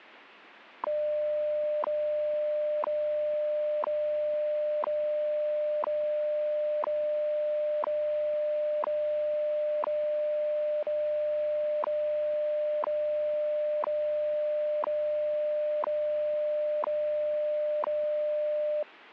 Radio time signal (WWV, Colorado), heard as ticks, one a second.